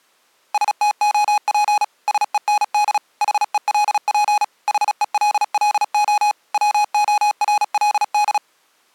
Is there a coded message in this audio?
Yes: Morse code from 0.5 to 8.4 s, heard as electronic beeps, machine-sent, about 36 wpm, 830 Hz. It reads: STOP SEND HELP HELLO WORLD